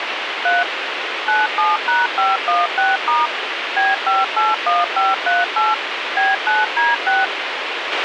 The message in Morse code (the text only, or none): none